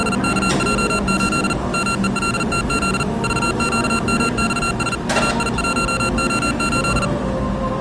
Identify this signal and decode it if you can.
Morse code, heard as electronic beeps, machine-sent, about 40 wpm, 1370 Hz, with the noise of a cafe. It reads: … MELTZ VQMXS AI1O8